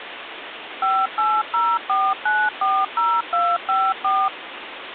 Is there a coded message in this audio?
Yes: DTMF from 0.8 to 4.3 s, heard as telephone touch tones, dialled by machine, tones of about 240 ms, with phone line noise. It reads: 5804940254